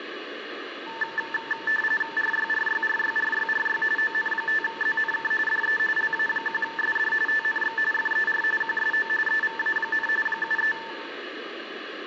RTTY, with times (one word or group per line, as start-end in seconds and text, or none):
2.2-3.8 RYRYRYRYRY
4.0-5.3 ON5ZNK
5.5-5.8 DE
6.0-7.1 LA1SD
7.3-7.8 TNX
7.9-8.4 FER
8.6-9.1 QSO
9.3-10.1 EVA,
10.3-10.7 73